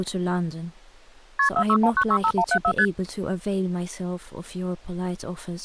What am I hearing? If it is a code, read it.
Multi-frequency trunk signalling (R1, as on North American trunks), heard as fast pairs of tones, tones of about 70 ms, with speech in English. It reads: KP 461965174 ST